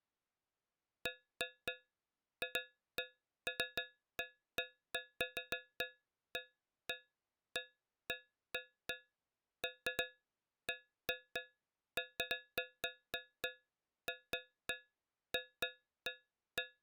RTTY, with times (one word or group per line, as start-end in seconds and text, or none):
none